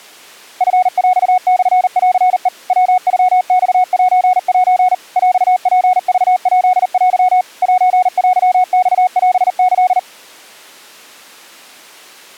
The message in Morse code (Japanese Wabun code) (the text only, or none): チヰモンヘ ヤノマセセ ヰツクヱテ セテマオキ